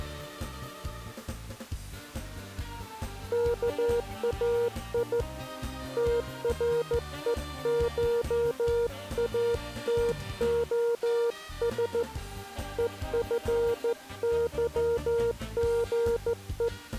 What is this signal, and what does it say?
Morse code (Greek alphabet), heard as a keyed tone, hand-sent with a straight key, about 14 wpm, 470 Hz. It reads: ΚΑΙ ΤΡΕΧΑΤΟΣ ΕΦΥΓΕ